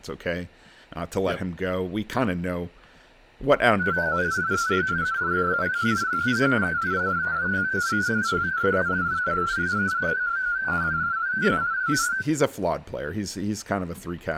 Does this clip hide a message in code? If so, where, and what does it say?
Yes: multi-tone FSK (Olivia or MFSK type), about 250 Hz wide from 3.8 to 12.3 s, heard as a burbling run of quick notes, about 31.25 baud, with speech in English.